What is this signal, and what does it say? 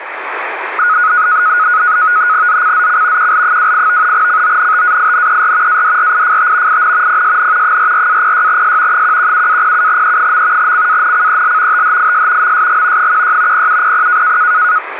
NAVTEX (SITOR-B), 100 baud, 170 Hz shift, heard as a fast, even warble, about 1360 Hz centre, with radio static. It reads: ZCZC QL28 CONTAINER ADRIFT IN PSN 44-06S 117-07E. CANCEL THIS MSG 16 0700